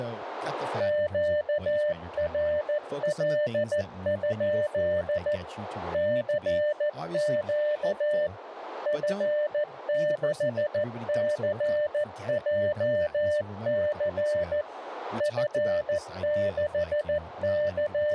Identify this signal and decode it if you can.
Morse code, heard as a keyed tone, machine-sent, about 14 wpm, 600 Hz, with radio static, a narrow filter and speech in English. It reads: QRL? CQ F6CJC …